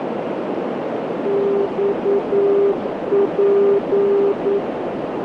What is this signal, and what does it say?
Morse code, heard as a keyed tone, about 9 wpm, 400 Hz, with heavy radio static and a narrow filter. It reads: XP